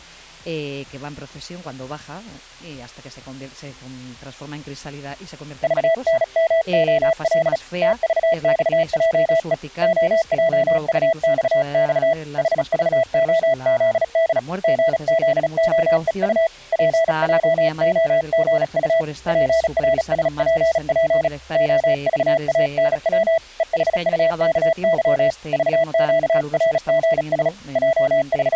Morse code, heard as a keyed tone, hand-sent with a paddle, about 36 wpm, 660 Hz. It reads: VNMOL TVXJE OJUXX HVOZD GZOEU PJOGU PRSPP OVANW EHUKY VQRGS …